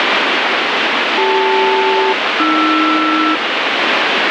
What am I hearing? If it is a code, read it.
Aircraft SELCAL, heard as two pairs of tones, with heavy radio static. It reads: CL-AR